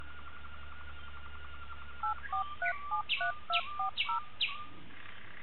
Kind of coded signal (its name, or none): DTMF